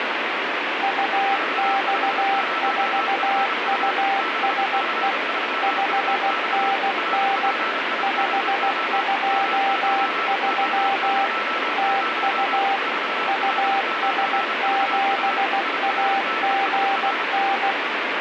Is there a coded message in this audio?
Yes: Morse code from 0.8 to 17.8 s, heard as two keyed tones, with heavy radio static. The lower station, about 16 wpm, 790 Hz: UX4USE 5NN 523 TU US7AGN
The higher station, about 31 wpm, 1320 Hz: 450FU 6C3UX RPIBO M9O00 4L9VU IRDSR